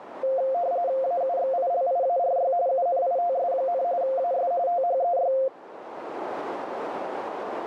RTTY (45.45 baud, 170 Hz shift), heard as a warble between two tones, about 620 Hz centre, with radio static and a narrow filter. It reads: AUXILIARY UNITS, AS THEY